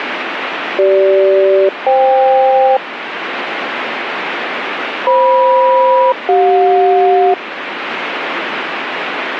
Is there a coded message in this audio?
Yes: aircraft SELCAL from 0.8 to 7.3 s, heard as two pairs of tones, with radio static. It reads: CG-FK FM-CJ